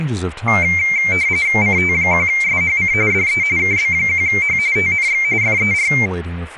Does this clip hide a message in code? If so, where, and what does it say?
Yes: RTTY (45.45 baud, 170 Hz shift) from 0.5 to 6.1 s, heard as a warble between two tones, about 2200 Hz centre, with speech in English. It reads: CT1SHC DE KB1H TNX FER